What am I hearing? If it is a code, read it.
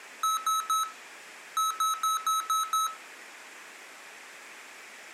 Beep code, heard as beeps from a small speaker, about 1290 Hz. 3-6.